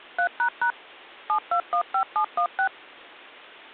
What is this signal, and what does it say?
DTMF, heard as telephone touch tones, dialled by machine, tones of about 90 ms. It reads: 3## 7215716